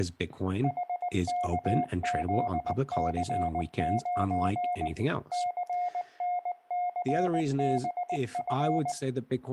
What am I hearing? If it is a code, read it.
Morse code, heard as a keyed tone, machine-sent, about 19 wpm, 720 Hz, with room echo and speech in English. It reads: HKZC9 CNCBF